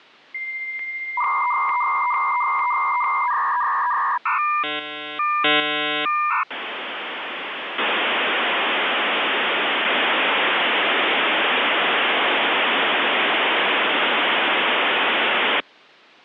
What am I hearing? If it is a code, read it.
Dial-up modem handshake (V.34 or later), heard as a whistle, warbles, then hiss.